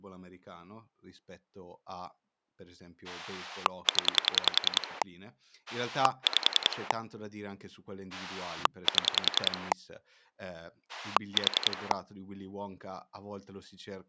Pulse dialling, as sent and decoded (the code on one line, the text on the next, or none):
10 / 5 / 7 / 4
0 5 7 4